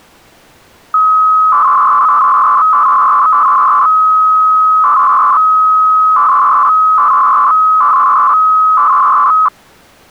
300-baud modem data (Bell 103 tones), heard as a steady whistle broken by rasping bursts, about 300 baud, 200 Hz shift.